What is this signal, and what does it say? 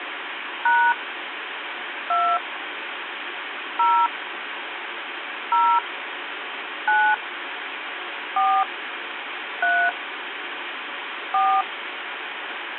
DTMF, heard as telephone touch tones, dialled by hand, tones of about 270 ms, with phone line noise. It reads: # 2 0 0 9 4 3 4